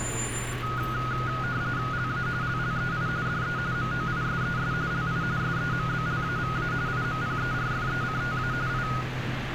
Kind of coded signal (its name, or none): RTTY